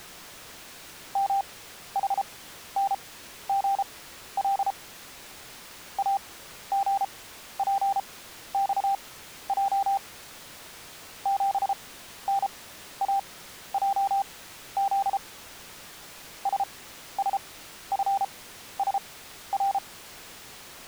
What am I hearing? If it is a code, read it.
Morse code, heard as a keyed tone, machine-sent, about 33 wpm, spaced as for 13 wpm, 790 Hz. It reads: MHNGL AGPXJ 7NAJZ SSFSR